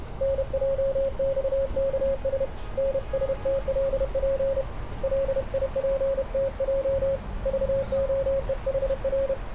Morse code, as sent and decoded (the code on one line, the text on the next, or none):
-. .--- -..- -.- ... / -. ... - .-.. .--. / .-.. .. .--. - .--- / ...- --- . .... .-.
NJXKS NSTLP LIPTJ VOEHR